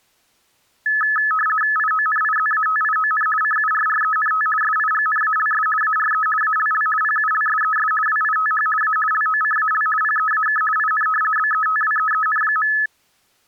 RTTY (50 baud, 450 Hz shift), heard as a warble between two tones, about 1500 Hz centre. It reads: IONIZATION CURRENT SIGNALS ARE ALL PULSES WITH A LOCAL PEAK IN BETWEEN.